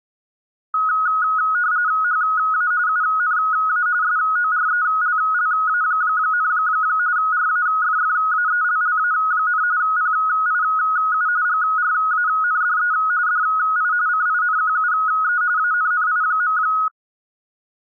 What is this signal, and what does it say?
RTTY (45.45 baud, 170 Hz shift), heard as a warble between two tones, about 1360 Hz centre. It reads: HA UNA SORELLA, RAFFAELLA, PIU GRANDE DI CINQUE ANNI.